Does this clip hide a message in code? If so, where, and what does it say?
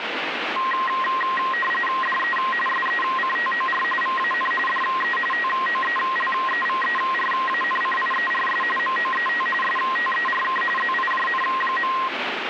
Yes: RTTY (45.45 baud, 850 Hz shift) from 0.6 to 12.1 s, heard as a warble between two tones, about 1480 Hz centre, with radio static. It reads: DE SECTOR VAN DE TOELEVERANCIERS MOET STERK ZIJN.